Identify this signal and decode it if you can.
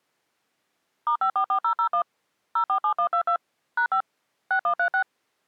DTMF, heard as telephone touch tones, dialled by machine, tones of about 90 ms. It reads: *544001 047122 #5 6136